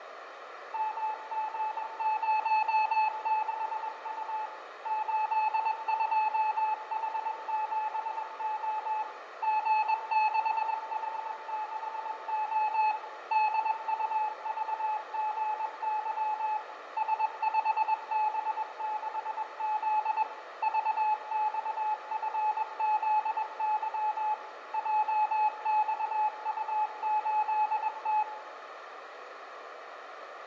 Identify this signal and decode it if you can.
Morse code, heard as a keyed tone, machine-sent, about 21 wpm, 860 Hz, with radio static, fading and room echo. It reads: MG06U 82H7O G6H6O DUVGY S5B6Z VXFZY JXU8T